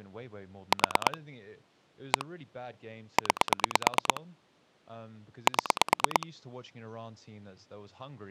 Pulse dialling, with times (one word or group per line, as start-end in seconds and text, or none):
0.7-1.2 4
2.1-2.3 1
3.2-4.2 9
5.5-6.3 7